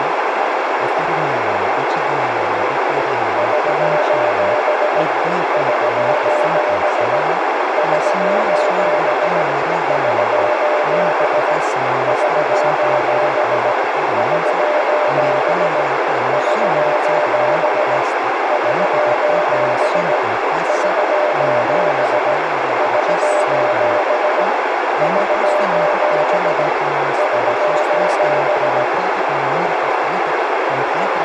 Morse code, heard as a keyed tone, hand-sent with a paddle, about 17 wpm, 600 Hz, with heavy radio static, a narrow filter and speech in Italian. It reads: <SOS> <SOS> <SOS> <SOS> <SOS> <SOS> <SOS> <SOS> <SOS> <SOS> <SOS> <SOS>